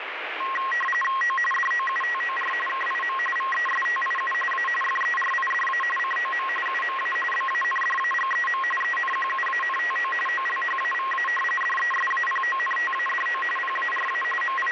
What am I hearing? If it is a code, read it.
RTTY (45.45 baud, 850 Hz shift), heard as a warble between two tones, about 1490 Hz centre, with radio static. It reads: O DOUTOR KIM VESTIU A FERIDA COM UMA BANDAGEM ENQUANTO OLHAVA DESAPONTADO PARA …